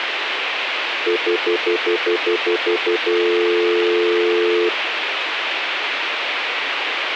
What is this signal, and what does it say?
Telephone call progress tone (North American plan), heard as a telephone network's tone, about 350, 440 Hz, 0.1 s on and 0.1 s off, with phone line noise. Stutter dial tone.